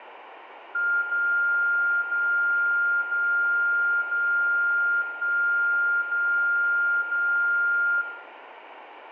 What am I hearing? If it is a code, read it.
Radio time signal (DCF77), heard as a tone whose level steps once a second, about 1400 Hz, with room echo. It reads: 0 0 0 0 1 0 0